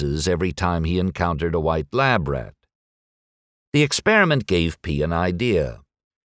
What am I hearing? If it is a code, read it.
Speech in English. There is no code.